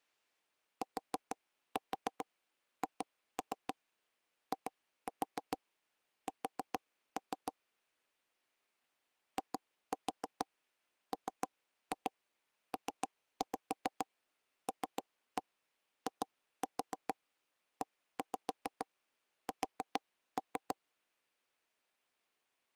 Tap code, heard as taps on a table, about 7 knocks a second. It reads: THIS IMPLIES